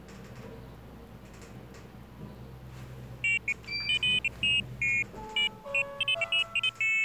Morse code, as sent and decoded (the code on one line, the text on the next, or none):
none